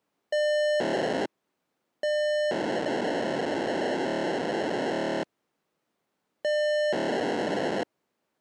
POCSAG pager data (1200 baud), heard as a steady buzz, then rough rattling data.